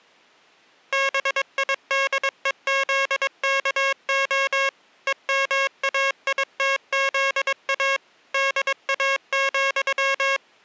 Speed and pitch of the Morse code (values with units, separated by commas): 22 wpm, 540 Hz